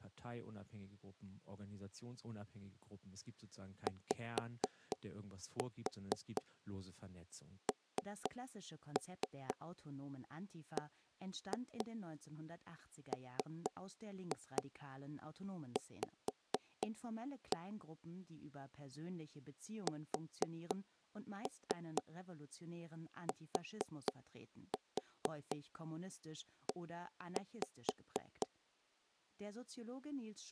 Tap code, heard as knocks on wood, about 4 knocks a second, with speech in German. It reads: YNBMV STE